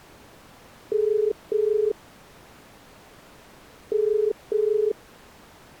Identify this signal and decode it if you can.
Telephone call progress tone (as in the UK, Ireland, Australia and similar networks), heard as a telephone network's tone, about 430 Hz. Ringback tone.